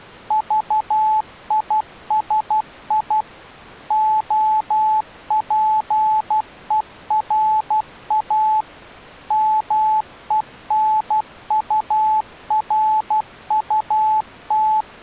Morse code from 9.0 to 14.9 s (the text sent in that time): MENURUT